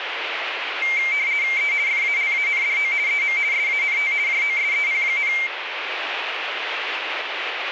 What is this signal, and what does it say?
RTTY (50 baud, 170 Hz shift), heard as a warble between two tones, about 2200 Hz centre, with radio static. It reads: E FALANDO EM SANT JOSEP,